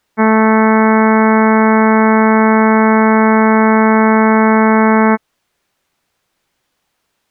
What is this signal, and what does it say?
Ship horn signal, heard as a ship's horn, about 220 Hz. 1 long. At sea: a vessel nearing a blind bend, or under power and making way in fog.